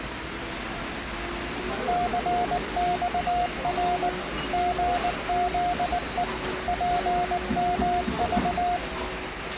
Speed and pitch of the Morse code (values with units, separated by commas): 19 wpm, 710 Hz